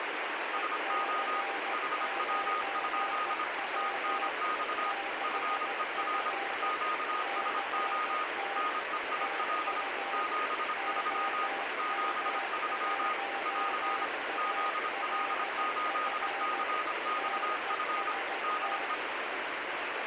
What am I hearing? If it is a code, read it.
Morse code, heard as two keyed tones, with heavy radio static. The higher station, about 26 wpm, 1240 Hz: SO HW? TNX FER QSO NEIL 73 73 <AR> ZL8CXF DE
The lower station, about 15 wpm, 790 Hz: EC9W 6F CT TU OM1ALF TEST